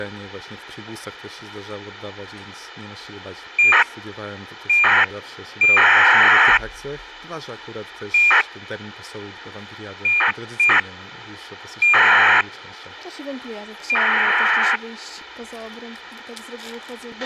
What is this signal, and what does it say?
ACARS aircraft data, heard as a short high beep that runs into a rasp, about 2400 baud, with a squelch burst at the end.